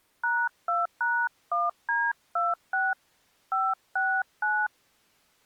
DTMF, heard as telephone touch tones, dialled by hand, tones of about 220 ms. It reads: #2#1D26 569